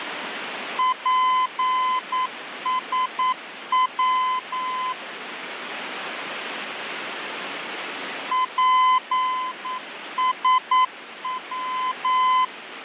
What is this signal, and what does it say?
Morse code, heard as a keyed tone, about 9 wpm, 1020 Hz, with radio static. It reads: PSW PSW